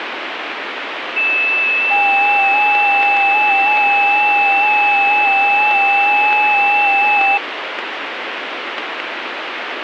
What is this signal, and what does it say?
FT8 (several signals at once), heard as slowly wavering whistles, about 6.25 baud, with radio static.